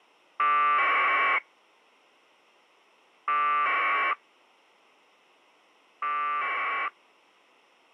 Packet radio (AX.25, as in APRS), 1200 baud, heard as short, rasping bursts.